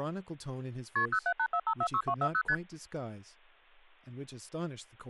Multi-frequency trunk signalling (R1, as on North American trunks), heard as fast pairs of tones, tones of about 70 ms, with speech in English. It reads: KP 0784546240 ST